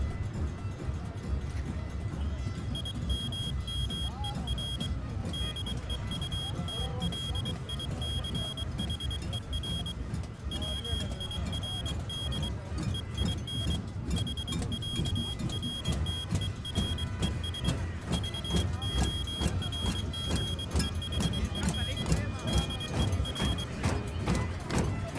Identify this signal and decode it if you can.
Morse code (with German letters), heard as a high beeper, hand-sent with a paddle, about 23 wpm, 3250 Hz. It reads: IMMER DEUTLICHER WIRD EIN HÄRTERES VORGEHEN DER